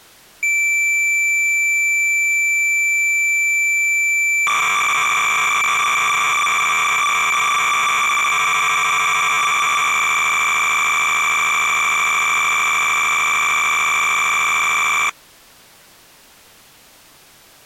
Cassette data (Kansas City type), 300 baud, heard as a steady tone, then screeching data.